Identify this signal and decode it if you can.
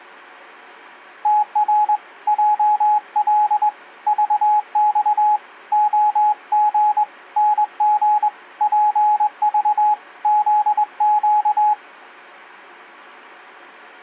Morse code, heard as a keyed tone, hand-sent with a straight key, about 21 wpm, 840 Hz. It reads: TR JL VX OG NG PV ZQ